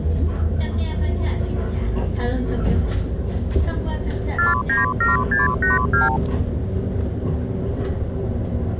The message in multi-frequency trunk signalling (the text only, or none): 497682